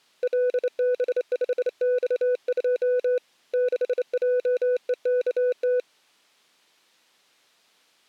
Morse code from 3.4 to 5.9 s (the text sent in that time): 6JEKT